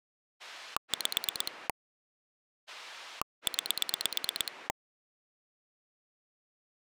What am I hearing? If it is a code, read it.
Pulse dialling, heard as a rotary dial, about 9 pulses a second. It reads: 5 9